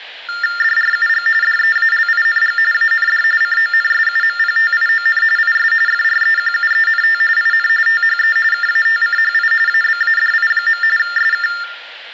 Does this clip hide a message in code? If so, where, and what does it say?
Yes: TTY/TDD text telephone tones (45.45 baud Baudot) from 0.3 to 11.6 s, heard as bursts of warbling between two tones, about 400 Hz shift, 1600 Hz centre. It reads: DRUG DEALING AND CONSUMPTION IS FREQUENT IN THE KATCHI ABADI. SK